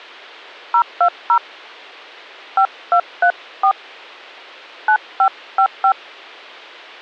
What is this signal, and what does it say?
DTMF, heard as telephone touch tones, dialled by hand, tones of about 80 ms. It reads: 020 5234 9555